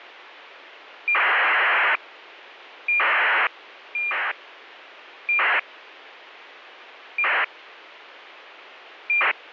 ACARS aircraft data, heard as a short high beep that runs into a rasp, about 2400 baud, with a squelch burst at the end.